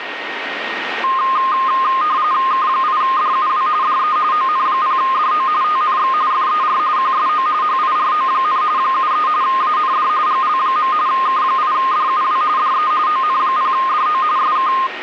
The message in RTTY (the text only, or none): K8DUW DE ON0DO TNX FER QSO HIRO, 73 AND GL. K8DUW DE ON0DO SK